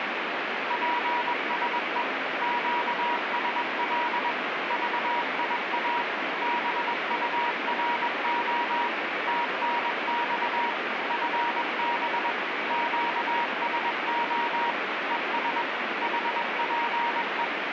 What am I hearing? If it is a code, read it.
Morse code, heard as a keyed tone, machine-sent, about 21 wpm, 950 Hz, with heavy radio static. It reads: PSE QSL VIA BURO TNX FB QSO ES HPE